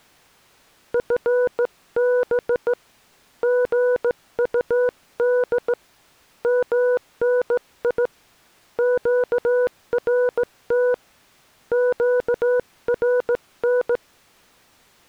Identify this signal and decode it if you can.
Morse code, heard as a keyed tone, hand-sent with a straight key, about 16 wpm, 500 Hz. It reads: FB GUD MNI QRT QRN